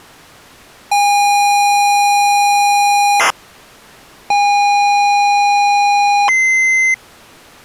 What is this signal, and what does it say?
ZX Spectrum tape loading, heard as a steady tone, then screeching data.